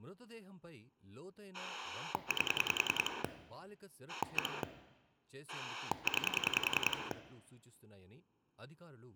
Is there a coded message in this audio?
Yes: pulse dialling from 1.5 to 7.1 s, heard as a rotary dial, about 10 pulses a second, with room echo and speech in Telugu. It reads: 8 1 9